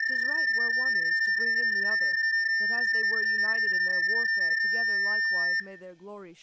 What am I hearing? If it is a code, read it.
PSK31 (31.25 baud), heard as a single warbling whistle, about 1800 Hz, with room echo and speech in English.